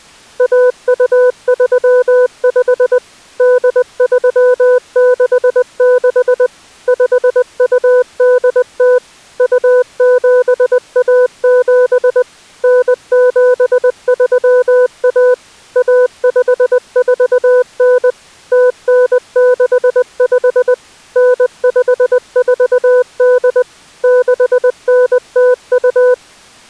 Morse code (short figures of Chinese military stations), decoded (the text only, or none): 1235 8366 5280 2717 9731 1549 0965 9548 6902